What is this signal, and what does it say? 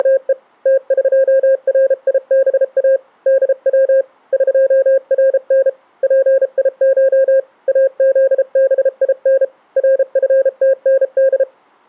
Morse code (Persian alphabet), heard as a keyed tone, hand-sent with a paddle, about 33 wpm, 540 Hz. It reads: … تقریبا دو قرن پیش ازبین رفتند